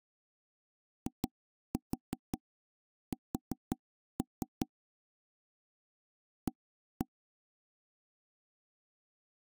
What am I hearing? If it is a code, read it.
Tap code, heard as knocks on wood, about 5 knocks a second. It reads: IS A